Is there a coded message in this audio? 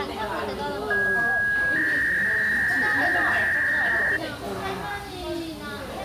Yes: 300-baud modem data (V.21 tones) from 0.9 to 4.2 s, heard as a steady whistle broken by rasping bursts, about 300 baud, 200 Hz shift, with the noise of a restaurant.